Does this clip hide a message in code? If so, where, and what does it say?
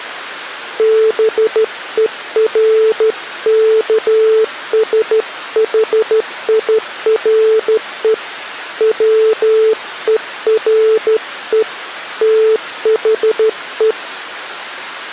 Yes: Morse code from 0.7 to 14.0 s, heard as a keyed tone, hand-sent with a straight key, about 13 wpm, 440 Hz. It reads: BERKSHIRE WERE THE